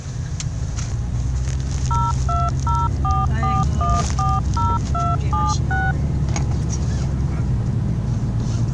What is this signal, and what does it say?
DTMF, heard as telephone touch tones, dialled by machine, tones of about 210 ms, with the noise inside a car. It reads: 02044140276